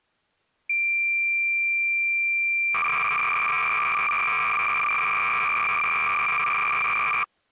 Cassette data (Kansas City type), 300 baud, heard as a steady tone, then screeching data.